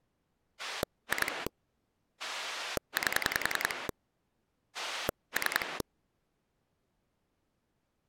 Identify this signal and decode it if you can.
Pulse dialling, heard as a rotary dial, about 10 pulses a second. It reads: 2 8 3